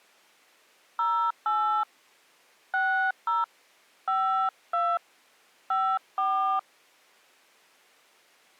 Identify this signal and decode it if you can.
DTMF, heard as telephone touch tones, dialled by hand, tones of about 290 ms. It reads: 08 60 52 54